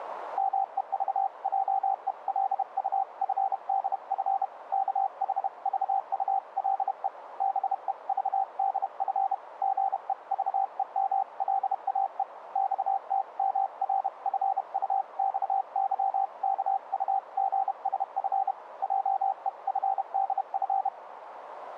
Morse code (Korean alphabet), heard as a keyed tone, hand-sent with a paddle, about 31 wpm, 780 Hz, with radio static. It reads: 말하기는 우리가 다른 사람과 커뮤니케이션 하는